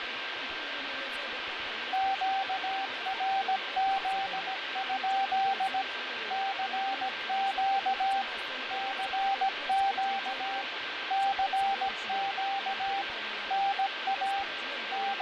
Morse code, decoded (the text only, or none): QRZ? CQ CQ CQ NA …